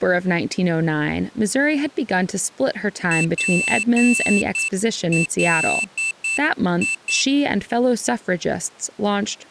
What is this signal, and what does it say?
Morse code, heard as a high beeper, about 9 wpm, 2650 Hz, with speech in English. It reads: PLI